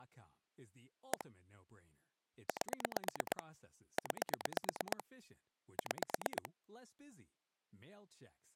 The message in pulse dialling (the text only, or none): 1 8 9 6